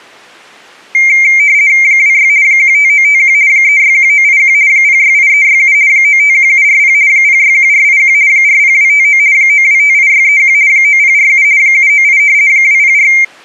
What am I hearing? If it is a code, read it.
RTTY (50 baud, 170 Hz shift), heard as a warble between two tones, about 2200 Hz centre. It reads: 26 15951 361981 068367 951740 061481 40259 9258631 9047 798 204